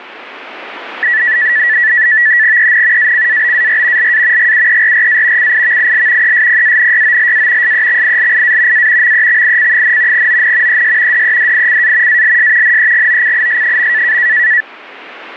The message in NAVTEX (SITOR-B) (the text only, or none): EN ACABAR LA GUERRA CIVIL ESPANYOLA SEXILIA A MEXIC, ON ES DEDICA ALS NEGOCIS.